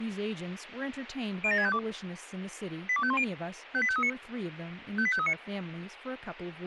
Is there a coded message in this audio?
Yes: five-tone selective call (ZVEI) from 1.4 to 5.3 s, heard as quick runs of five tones, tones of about 70 ms, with radio hiss and speech in English. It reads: 07652 82510 58539 58539